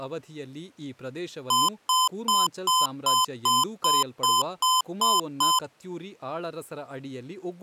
Beep code, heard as beeps from a small speaker, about 1020 Hz, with speech in Kannada. 11 short. In AMI BIOS tables: cache memory error.